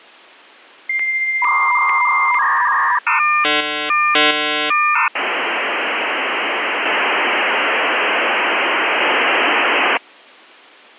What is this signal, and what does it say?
Dial-up modem handshake (V.34 or later), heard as a whistle, warbles, then hiss.